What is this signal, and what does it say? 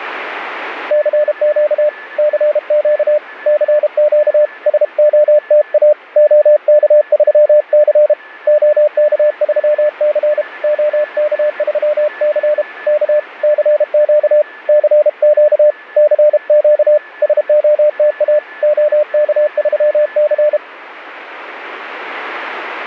Morse code, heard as a keyed tone, hand-sent with a paddle, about 32 wpm, 600 Hz, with radio static and a weaker station near 1740 Hz. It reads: CQ CQ CQ SOTA OK3C OK3C OK3C K CQ CQ CQ SOTA OK3C